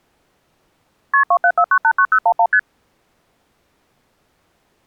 Multi-frequency trunk signalling (R1, as on North American trunks), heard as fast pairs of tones, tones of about 70 ms. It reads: KP 274989011 ST